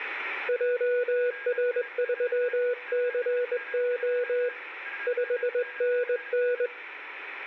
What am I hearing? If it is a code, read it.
Morse code, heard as a keyed tone, hand-sent with a straight key, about 21 wpm, 490 Hz, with radio static and a weaker station near 1630 Hz. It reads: JR3CO 5NN